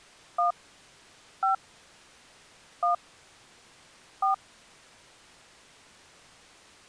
DTMF, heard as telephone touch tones, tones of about 120 ms. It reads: 1 5 1 4